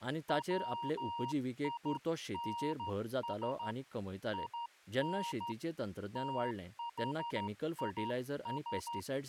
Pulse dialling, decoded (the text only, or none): none